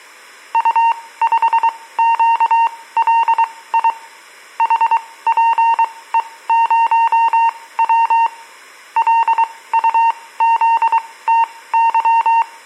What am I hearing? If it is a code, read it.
Morse code, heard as a keyed tone, machine-sent, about 23 wpm, spaced as for 17 wpm, 920 Hz, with room echo. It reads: U5QLI HPE0W LUZTY